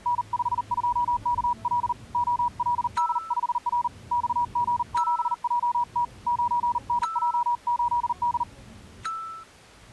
Morse code, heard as a keyed tone, hand-sent with a paddle, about 39 wpm, 960 Hz, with the noise inside a car. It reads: N52KL OLD5R XG7JT 9NJ8D